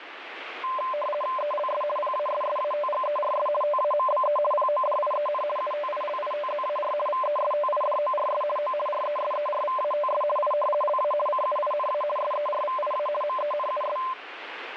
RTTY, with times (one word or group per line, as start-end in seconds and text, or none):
1.4-1.8 ELS
2.0-3.5 PASSATGERS
3.6-4.4 TAMBE
4.5-5.4 PODIEN
5.6-6.9 UTILITZAR
7.1-8.4 VESTIDORS
8.6-8.7 O
8.9-10.2 RESERVATS
10.4-10.5 I
10.8-11.1 LA
11.3-12.0 CUINA
12.2-13.1 SERVIA
13.2-14.0 MENUS